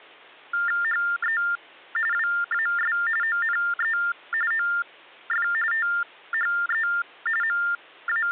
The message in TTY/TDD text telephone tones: HE WAS ONE OF THE …

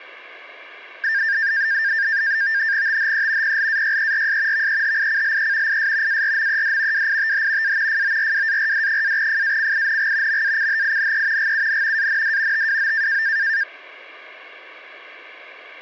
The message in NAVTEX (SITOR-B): THE PLAYERS VEHICLE IS ARMED WITH A FORWARD-FACING MACHINE GUN AND TWO

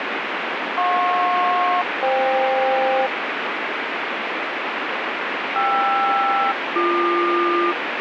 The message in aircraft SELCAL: JP-FK KR-BQ

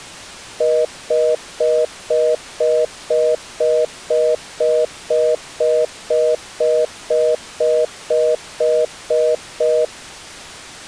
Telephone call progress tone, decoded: congestion tone

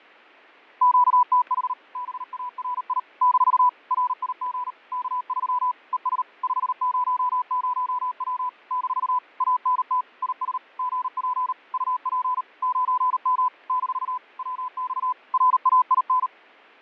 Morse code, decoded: QTH BARI - RIG K3 ES 500W - ANT IS GP UP 9M - WX RAIN

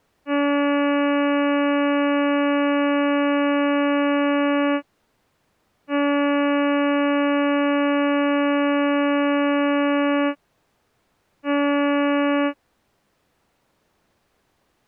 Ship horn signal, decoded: 2 long, 1 short

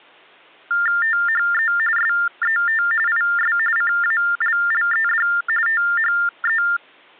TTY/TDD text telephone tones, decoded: THE SET IS CALLED THE

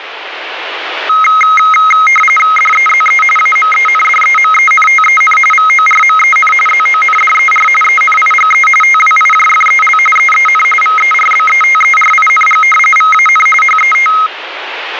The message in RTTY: DEZE AMENDEMENTEN VORMEN ZONDER ENIGE TWIJFEL EEN VERBETERING VAN HET

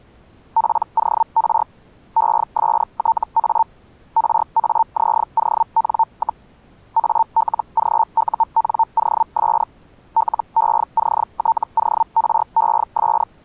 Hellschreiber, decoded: POR ESTA RAZON, ALGUNOS LECTORES

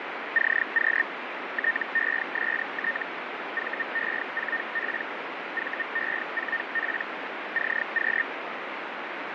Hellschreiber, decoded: CQ TEST VE4P VE4P CQ

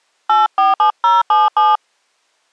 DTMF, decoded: 847077

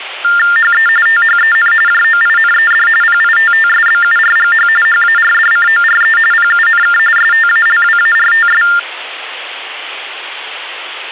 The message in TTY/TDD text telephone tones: HE THEN JOINED PITTSBURGH HARDCORE PUNK STALWARTS

